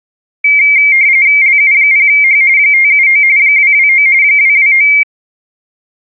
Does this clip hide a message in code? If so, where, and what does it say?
Yes: RTTY (45.45 baud, 170 Hz shift) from 0.4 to 5.0 s, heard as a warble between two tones, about 2200 Hz centre. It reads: LU0H 579 229 229